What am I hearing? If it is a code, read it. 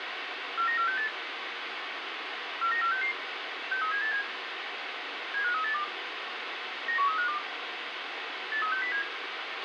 Five-tone selective call (CCIR), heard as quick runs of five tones, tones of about 100 ms, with radio hiss and a squelch burst at the end. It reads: 49468 49466 63787 75382 91352 83607